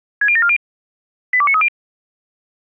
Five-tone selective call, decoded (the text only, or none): 60740 82930